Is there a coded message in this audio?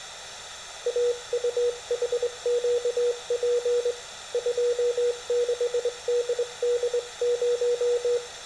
Yes: Morse code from 0.8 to 8.2 s, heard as a keyed tone, hand-sent with a straight key, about 22 wpm, 480 Hz, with room echo. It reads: AUHQP 26DD0